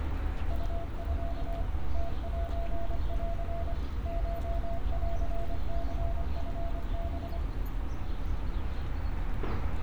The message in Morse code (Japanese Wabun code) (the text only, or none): ウミ ムセン コンニチハ